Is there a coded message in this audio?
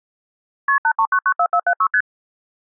Yes: multi-frequency trunk signalling (R1, as on North American trunks) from 0.7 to 2.0 s, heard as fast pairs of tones, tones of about 70 ms. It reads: KP 83994476 ST